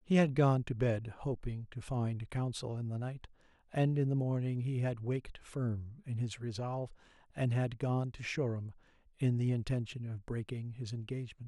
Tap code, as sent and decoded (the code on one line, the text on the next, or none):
none